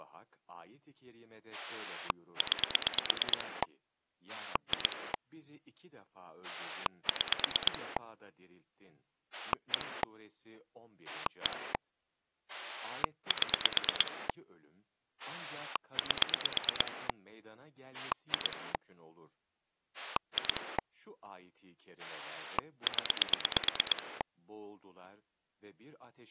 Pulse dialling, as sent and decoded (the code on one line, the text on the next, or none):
9 / 2 / 6 / 1 / 1 / 7 / 8 / 2 / 2 / 10
9 2 6 1 1 7 8 2 2 0